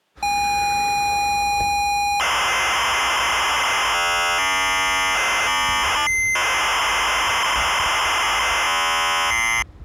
ZX Spectrum tape loading, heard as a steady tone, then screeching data, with the noise of a residential street.